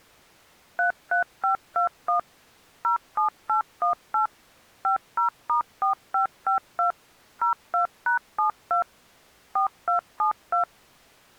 DTMF, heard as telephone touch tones, dialled by machine, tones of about 110 ms. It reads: 33521 07818 50*4552 02#72 4272